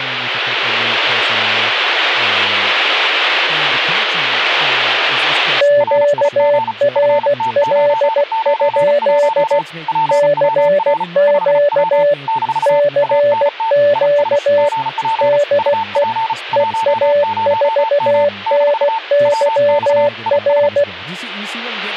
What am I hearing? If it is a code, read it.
Morse code, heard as two keyed tones, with speech in English. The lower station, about 16 wpm, 580 Hz: QRL? CQ CQ DE EA4NYR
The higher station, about 35 wpm, 900 Hz: RIG FT991 PWR 5W - ANT IS GP UP 10M - WX IS